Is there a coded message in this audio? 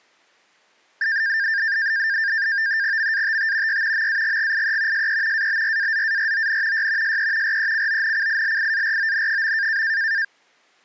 Yes: NAVTEX (SITOR-B), 100 baud, 170 Hz shift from 1.0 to 10.2 s, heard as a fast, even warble, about 1700 Hz centre. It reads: MATT Y MAGGIE SE ABRAZARON Y SE RECONCILIARON.